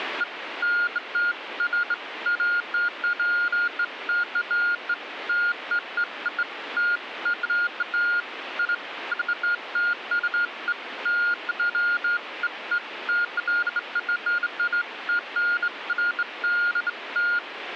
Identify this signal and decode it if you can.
Beeps of irregular length, with radio static. There is no code.